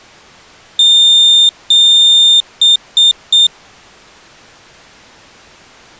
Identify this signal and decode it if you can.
Beep code, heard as a piezo beeper, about 3600 Hz. 2 long, 3 short.